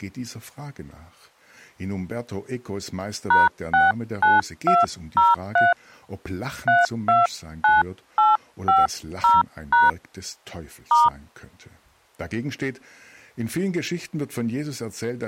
DTMF, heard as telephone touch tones, dialled by hand, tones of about 180 ms. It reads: #69203 329850# *